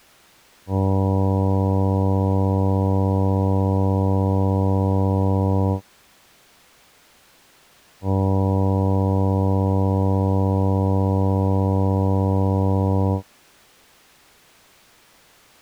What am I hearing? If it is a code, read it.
Ship horn signal, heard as a ship's horn, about 100 Hz. 2 long. At sea: a vessel under power that has stopped in fog.